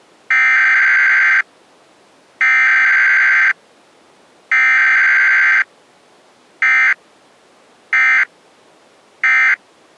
Emergency Alert System (SAME) tones (header bursts, then end-of-message bursts), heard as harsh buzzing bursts, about 520.83 baud.